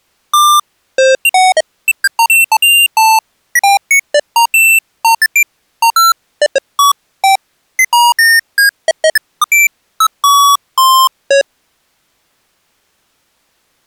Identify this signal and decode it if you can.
Electronic bleeps of random pitch and length. There is no code.